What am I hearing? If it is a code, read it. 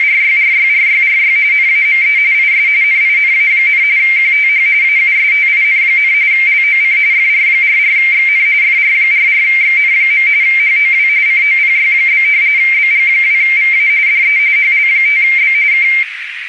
RTTY (45.45 baud, 170 Hz shift), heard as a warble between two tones, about 2200 Hz centre, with radio static and a narrow filter. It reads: … NAME IS NINA, QTH AUSTIN, LOC FR44XN FR44XN. HOW COPY? BG2VA DE HL5B K